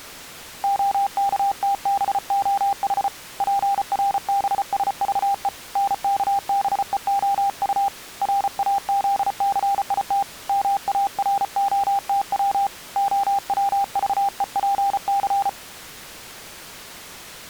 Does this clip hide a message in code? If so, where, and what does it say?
Yes: Morse code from 0.6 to 15.6 s, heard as a keyed tone, hand-sent with a paddle, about 34 wpm, 800 Hz. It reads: OKTBOH PRBSVE NKBEOU RAZCIT MAROTW OWVEPC